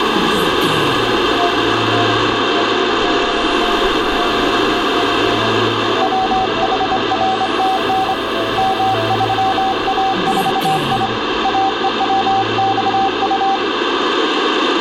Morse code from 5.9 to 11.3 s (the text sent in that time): WHRTN M3A4I